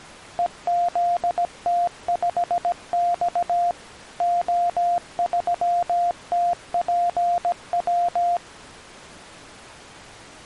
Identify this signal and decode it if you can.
Morse code, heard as a keyed tone, machine-sent, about 17 wpm, 700 Hz. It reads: EZT5X O3TPW